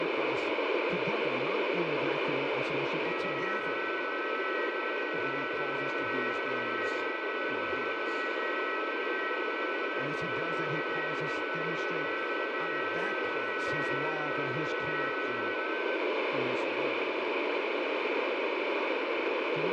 FT8 (several signals at once), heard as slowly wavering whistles, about 6.25 baud, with radio static, room echo and speech in English.